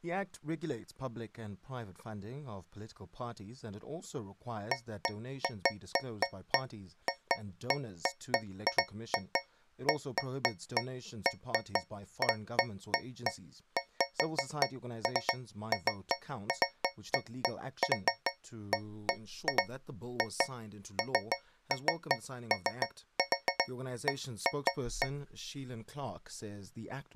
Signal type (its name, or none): none